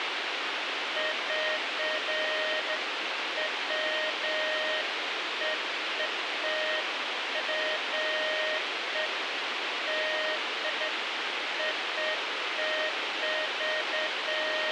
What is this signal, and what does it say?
Beeps of irregular length, with radio hiss. There is no code.